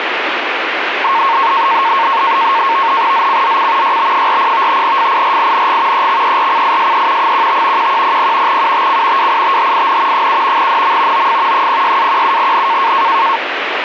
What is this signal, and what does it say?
NAVTEX (SITOR-B), 100 baud, 170 Hz shift, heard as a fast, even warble, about 1000 Hz centre, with radio static. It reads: ZCZC YB40 FIRING EXERCISE 15 1100 UTC WITHIN 7 NM OF 06-17N